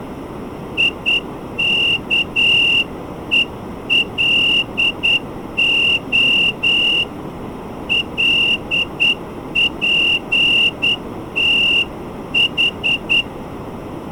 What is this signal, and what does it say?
Morse code (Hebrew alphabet), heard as a whistle, hand-sent with a straight key, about 9 wpm. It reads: יכולה לפתח